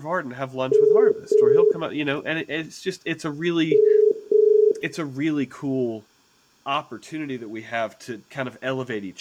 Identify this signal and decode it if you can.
Telephone call progress tone (as in the UK, Ireland, Australia and similar networks), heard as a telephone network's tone, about 430 Hz, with room echo and speech in English. Ringback tone.